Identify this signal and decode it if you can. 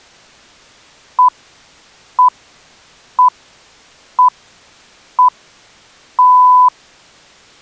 Radio time signal (six pips, as the Greenwich Time Signal), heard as pips.